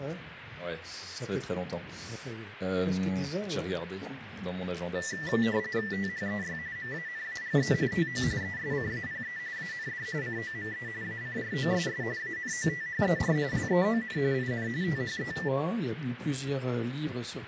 RTTY (45.45 baud, 170 Hz shift), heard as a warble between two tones, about 1850 Hz centre, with radio static. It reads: THEY MANAGE TO ESCAPE AND COME ACROSS ANOTHER LEON IN THE